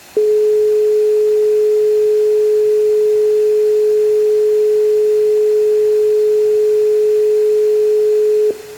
Telephone call progress tone (425 Hz plan, as in most of Europe), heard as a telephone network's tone, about 420 Hz, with room echo. Dial tone.